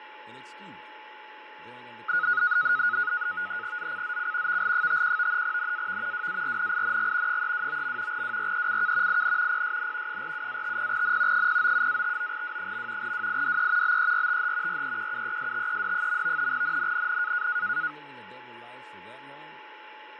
NAVTEX (SITOR-B), 100 baud, 170 Hz shift, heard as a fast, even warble, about 1360 Hz centre, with radio static, fading, a steady whistle near 860 Hz and speech in English. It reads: ZCZC VL51 NAV WARNING 329. WRECK IN PSN 47-50N 097-59W. WIDE BERTH REQUESTED. NNNN